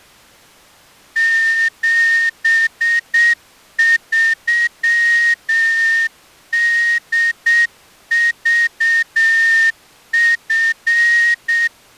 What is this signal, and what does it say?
Morse code, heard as a whistle, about 7 wpm. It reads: 73DVF